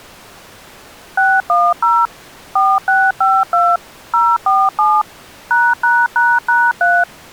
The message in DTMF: 610 4652 047 ####3

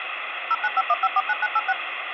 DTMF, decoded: 0951549986

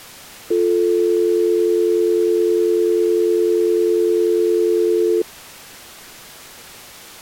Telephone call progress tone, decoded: dial tone

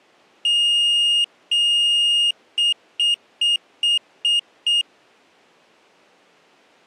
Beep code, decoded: 2 long, 6 short

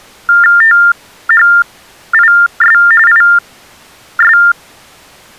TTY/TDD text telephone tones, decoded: THIS IS

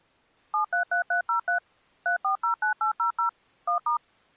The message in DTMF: 733303 3409800 1*

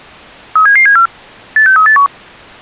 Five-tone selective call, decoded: 37774 86381

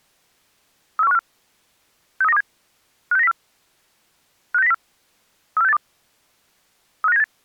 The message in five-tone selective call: 34154 63927 56904 56904 34682 35978

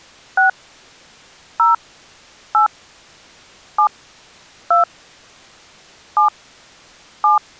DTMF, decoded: 6 0 8 7 2 7 7

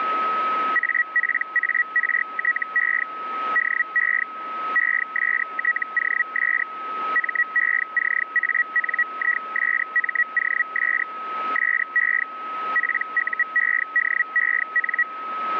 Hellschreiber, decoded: APARTE DE ESTOS MECANISMOS SE PUEDEN

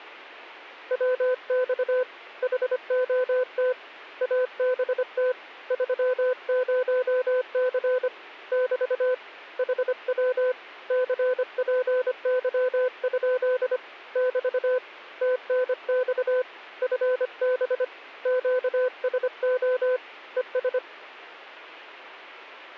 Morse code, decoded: WX HOT ABT 30C <BT> HW CPY? <BT> TNX FB QSO ES

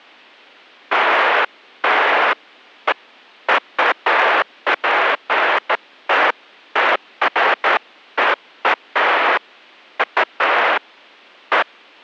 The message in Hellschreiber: none

